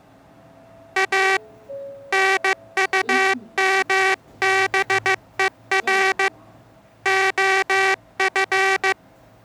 Morse code, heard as a buzzer, hand-sent with a paddle, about 15 wpm, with the noise inside a lift. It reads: A NUMBER OF